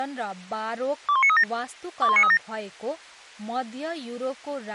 Five-tone selective call (ZVEI), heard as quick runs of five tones, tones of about 70 ms, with speech in Nepali. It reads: 21937 21937